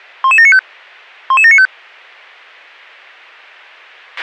Five-tone selective call (ZVEI), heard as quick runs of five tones, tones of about 70 ms, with a squelch burst at the end. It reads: 11795 11795